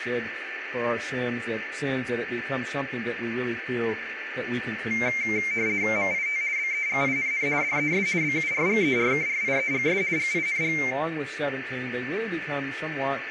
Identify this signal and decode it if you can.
RTTY (50 baud, 170 Hz shift), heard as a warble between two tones, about 2200 Hz centre, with radio static, a steady whistle near 1770 Hz and room echo. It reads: MIT BEGINN DES BURGERKRIEGS GING